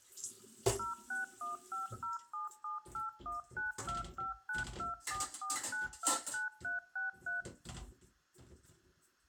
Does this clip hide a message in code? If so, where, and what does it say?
Yes: DTMF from 0.8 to 7.4 s, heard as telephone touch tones, dialled by machine, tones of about 140 ms, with room echo and kitchen noise. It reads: 0615077819259244929363